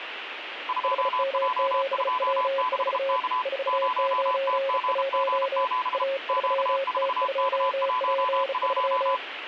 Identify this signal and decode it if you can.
Morse code, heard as two keyed tones, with radio static. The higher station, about 33 wpm, 1010 Hz: 2J26K 0TGG7 Q4K11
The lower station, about 35 wpm, 540 Hz: HM7W4 491 A3T2P3